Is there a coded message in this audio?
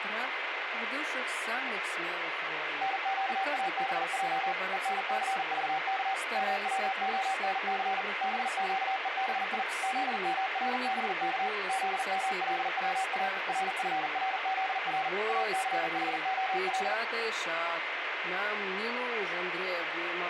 Yes: Morse code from 2.8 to 17.0 s, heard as a keyed tone, machine-sent, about 40 wpm, 770 Hz, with radio static. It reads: NQABJ ENCVK MWONC BQEBI ZMRBK ZMLWA RFRZR ACHOL